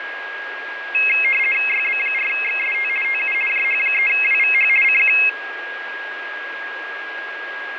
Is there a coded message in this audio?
Yes: RTTY (50 baud, 450 Hz shift) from 0.9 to 5.3 s, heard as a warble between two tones, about 2350 Hz centre, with radio static and a steady whistle near 1640 Hz. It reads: YB4XST TU JH3WVH CQ